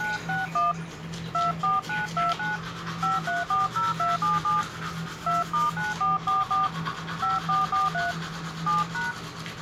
DTMF, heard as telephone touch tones, dialled by hand, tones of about 160 ms, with the noise of a restroom. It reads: 961 24929 5340277 2*9444 5443 7#